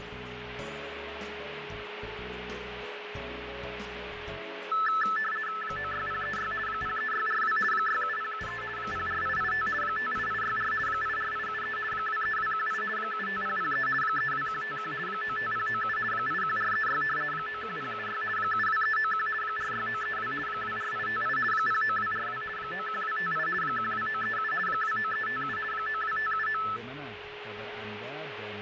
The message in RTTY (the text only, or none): 96036 03642 67073 04885 58864 84873 23218 75003 32151 95097 81436 91076 72391 46932 24858 09242 91258 12937 29357 92579